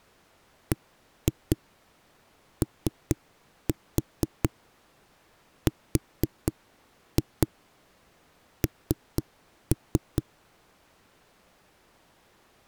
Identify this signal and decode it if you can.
Tap code, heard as knocks on a wall, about 4 knocks a second. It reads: BORN